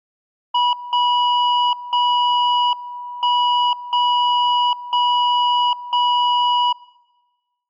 Radio time signal (WWVB), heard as a tone whose level steps once a second, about 980 Hz. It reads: 0 0 1 0 0 0